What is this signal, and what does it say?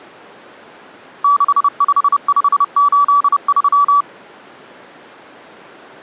Morse code, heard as a keyed tone, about 30 wpm, 1150 Hz. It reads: 65583